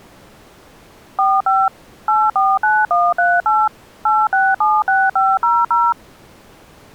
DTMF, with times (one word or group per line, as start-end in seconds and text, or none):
1.2-1.7 45
2.1-3.7 849138
4.1-5.9 8676500